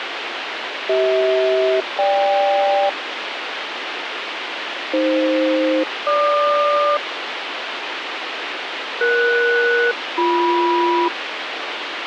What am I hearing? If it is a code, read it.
Aircraft SELCAL, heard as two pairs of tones, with radio hiss. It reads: CH-GK AF-GQ ES-BM